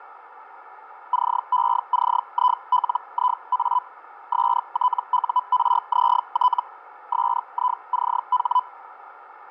Hellschreiber (Feld-Hell, 122.5 baud), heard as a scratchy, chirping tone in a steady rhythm, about 1000 Hz. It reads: CECILIA STURZT SICH